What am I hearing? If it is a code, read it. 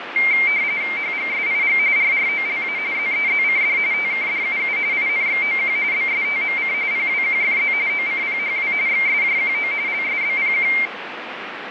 RTTY (45.45 baud, 170 Hz shift), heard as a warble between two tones, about 2200 Hz centre, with radio static. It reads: HGSIG RROLA ZEZCD TKDUU INXOQ BSTMC PWQFZ OCPHW XSJQO LSBPQ